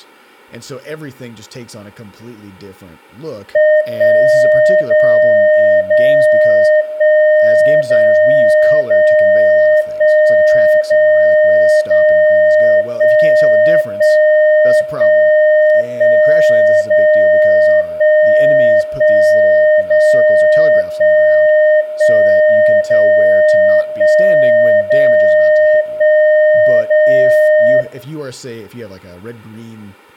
Radio time signal (DCF77), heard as a tone whose level steps once a second, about 610 Hz, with room echo and speech in English. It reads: 1 0 0 1 0 0 1 0 0 1 1 1 1 0 1 1 0 1 1 0 1 0 1 0